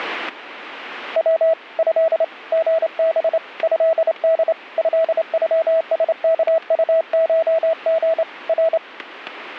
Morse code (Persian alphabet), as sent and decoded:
.-- / ..-.. / --. -... / ..-.. -.. / ..-.. ..-- ... -.- ..- ---- --. / .-.
و ض ژب ضد ضغسکطشژ ر

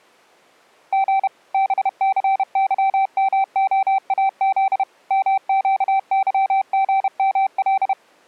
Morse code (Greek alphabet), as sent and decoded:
--. / -... -.-. -.-- -- --- .- --.. / -- --.- -.-- --. -- .-..
Γ ΒΘΥΜΟΑΖ ΜΨΥΓΜΛ

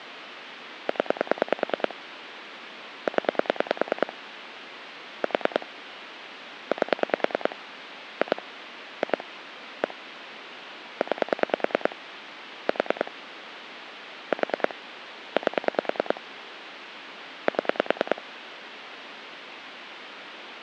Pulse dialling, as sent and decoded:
10 / 10 / 4 / 8 / 2 / 2 / 1 / 9 / 4 / 4 / 8 / 7
0 0 4 8 2 2 1 9 4 4 8 7

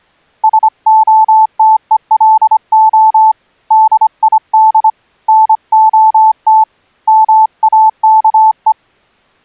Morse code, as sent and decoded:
... --- - . .-.. --- / -.. .. -.. / -. --- - / -- .- -.- .
SOTELO DID NOT MAKE

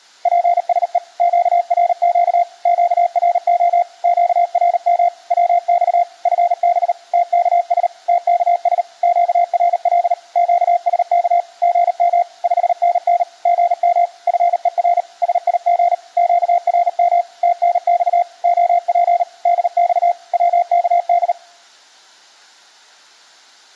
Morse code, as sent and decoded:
.--. ... . / --.- .-. --.- / --.- .-. --- / --.- .-. -- / .-- -..- / ..-. -... / - -.- ... / - -.- ... / --.- .-. .-.. / --.- ... -.- / --. -- / ..... -. -. / --. -- / ..-. . .-. / ... .. --. / --.- .-. -- / - -. -..- / --- .--. / -.. -..- / .-- -.- -..
PSE QRQ QRO QRM WX FB TKS TKS QRL QSK GM 5NN GM FER SIG QRM TNX OP DX WKD

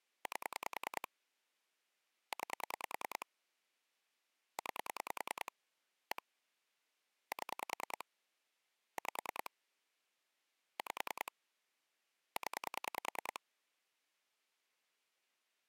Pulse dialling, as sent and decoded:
8 / 9 / 9 / 1 / 7 / 5 / 5 / 10
8 9 9 1 7 5 5 0

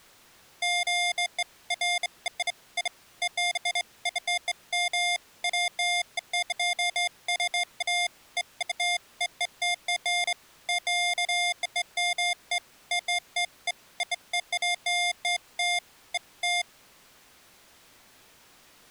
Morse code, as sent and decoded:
none

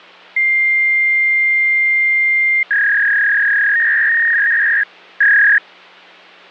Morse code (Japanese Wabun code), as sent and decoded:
none

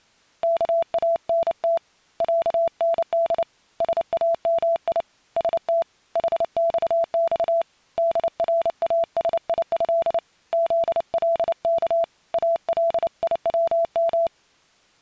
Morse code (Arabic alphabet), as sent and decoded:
-.- .- -. - / .-.- -. -.. / ... .- -- .. / ... - / .... -..- -..- / -.. .-. .- ... .. ..-.. / --.. .-.. -.- / .- .-.. .. .-- --
كانت عند سامي ست حصص دراسيه ذلك اليوم

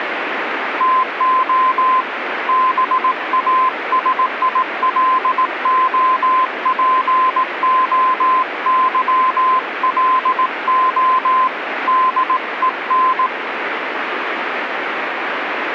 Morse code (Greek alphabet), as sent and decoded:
- --- / -... .- ... .. .-.. --- .--. --- -.-- .-.. --- / -.. . -.
ΤΟ ΒΑΣΙΛΟΠΟΥΛΟ ΔΕΝ

